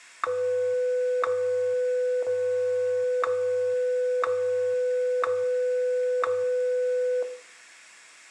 Radio time signal (WWVH, Hawaii), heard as ticks, one a second, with room echo.